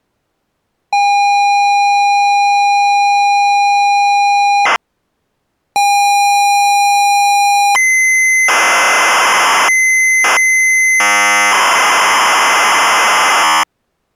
ZX Spectrum tape loading, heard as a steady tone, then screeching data.